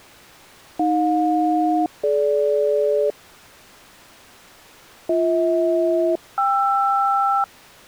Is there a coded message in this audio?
Yes: aircraft SELCAL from 0.8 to 7.4 s, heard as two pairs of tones. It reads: AJ-DG BH-KR